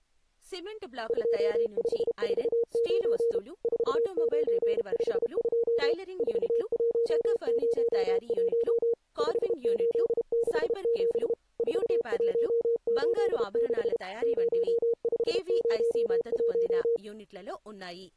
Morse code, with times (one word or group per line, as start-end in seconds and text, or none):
1.1-3.4 2549
3.6-5.9 4952
6.2-8.9 4101
9.2-11.3 5867
11.6-14.0 4186
14.2-17.0 0501